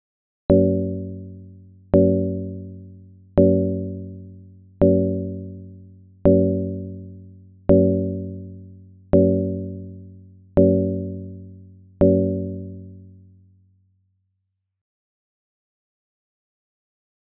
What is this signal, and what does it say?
Clock strike, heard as a bell. 9. Nine o'clock.